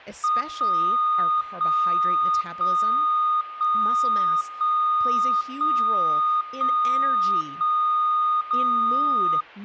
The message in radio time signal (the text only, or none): 1 1 1 1 1 1 1 1 0